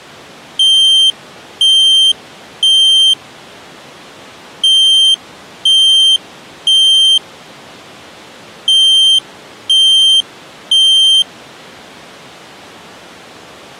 Alarm pattern, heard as an alarm's beeps, played three times, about 3150 Hz. Temporal three. Smoke or fire, evacuate.